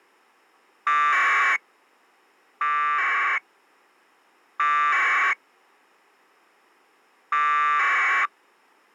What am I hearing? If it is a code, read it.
Packet radio (AX.25, as in APRS), 1200 baud, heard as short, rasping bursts.